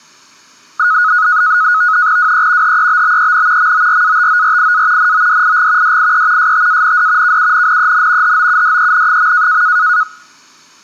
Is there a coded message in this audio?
Yes: NAVTEX (SITOR-B), 100 baud, 170 Hz shift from 0.8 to 10.0 s, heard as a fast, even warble, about 1360 Hz centre. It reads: WE HEBBEN MORATORIA NODIG DIE STAND KUNNEN HOUDEN.